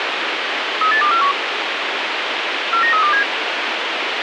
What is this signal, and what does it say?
Five-tone selective call (CCIR), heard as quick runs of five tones, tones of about 100 ms, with radio hiss. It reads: 38241 49327